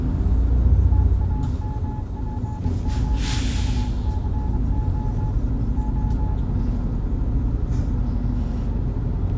Morse code, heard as a keyed tone, hand-sent with a bug key, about 25 wpm, 860 Hz, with the noise inside a bus. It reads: TAMPOUCO O